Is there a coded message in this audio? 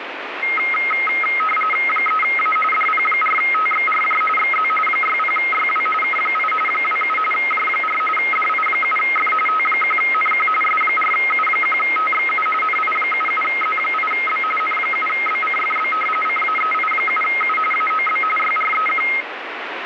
Yes: RTTY (45.45 baud, 850 Hz shift) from 0.4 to 19.2 s, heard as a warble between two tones, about 1700 Hz centre, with radio static. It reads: 3A DP4TXRJ XZ 60YW K8 27 J4 DI7F T1NQ S4U1TXU NI77Z8B N7BCFB CAEI7U AOB YREQ